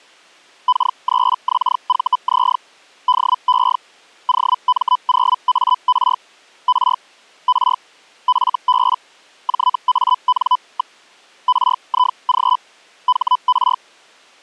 Hellschreiber (Feld-Hell, 122.5 baud), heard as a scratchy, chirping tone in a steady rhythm, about 1000 Hz. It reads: K3XVZ DE OM0AR R R FB JAN. RIG HR